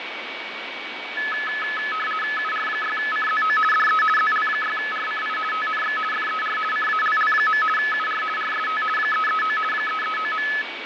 RTTY (50 baud, 450 Hz shift), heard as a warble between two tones, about 1500 Hz centre, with radio static, fading and a steady whistle near 2260 Hz. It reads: UR6CZO DE ZL6RCI TNX FER CALL. UR RST 339 339.